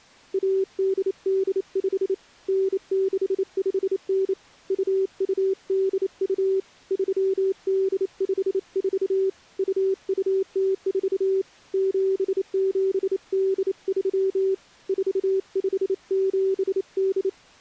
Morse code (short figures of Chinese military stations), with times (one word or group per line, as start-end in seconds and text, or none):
0.3-2.1 1885
2.5-4.3 9659
4.7-6.6 2282
6.9-9.3 3854
9.6-11.4 2204
11.7-14.5 7783
14.9-17.3 4578